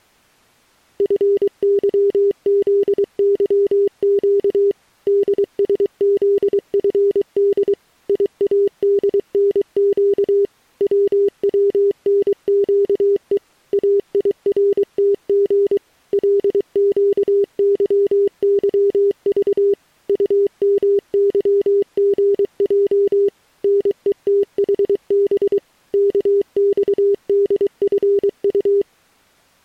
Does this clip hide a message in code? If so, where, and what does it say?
Yes: Morse code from 0.9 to 28.9 s, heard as a keyed tone, machine-sent, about 23 wpm, 400 Hz. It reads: FYZYQ DSZFD IADNQ WWNQE AIRTG LQYYV UMYGJ NETHB KXDFU